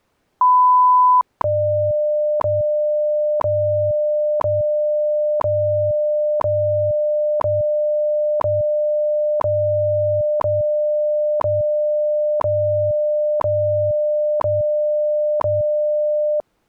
Radio time signal (WWV, Colorado), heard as ticks, one a second.